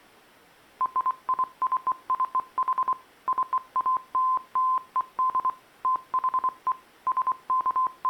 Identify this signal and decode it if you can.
Morse code (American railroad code), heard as a keyed tone, machine-sent, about 1030 Hz. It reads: RICCH CALLED THE …